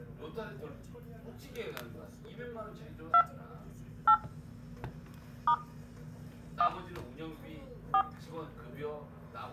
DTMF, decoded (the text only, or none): 2 8 * 1 4